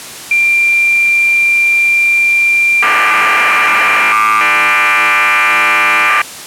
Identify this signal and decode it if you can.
Cassette data (Kansas City type), 1200 baud, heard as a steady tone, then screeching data.